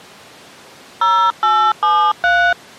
DTMF, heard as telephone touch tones, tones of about 290 ms. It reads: 0873